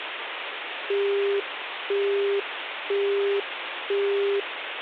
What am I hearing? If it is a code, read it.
Telephone call progress tone (single-tone plan, as in Europe, Japan and elsewhere), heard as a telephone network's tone, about 400 Hz, 0.5 s on and 0.5 s off, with phone line noise. Busy tone.